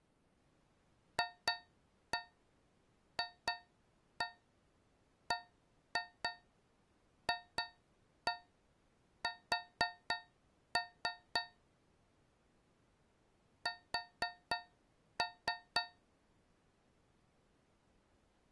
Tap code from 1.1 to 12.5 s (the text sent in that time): FFBFS